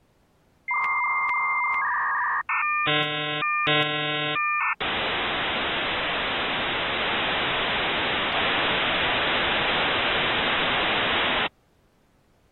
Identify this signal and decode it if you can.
Dial-up modem handshake (V.34 or later), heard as a whistle, warbles, then hiss.